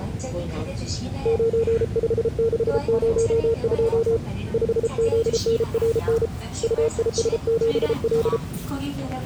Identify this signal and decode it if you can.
Morse code, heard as a keyed tone, hand-sent with a paddle, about 33 wpm, 460 Hz, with the noise inside a subway train. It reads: 95602 5ZNRN UIS7L